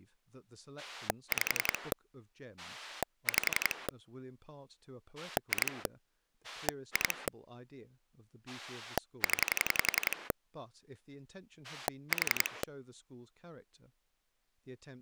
Pulse dialling, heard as a rotary dial, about 11 pulses a second, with speech in English. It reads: 5 5 2 2 0 4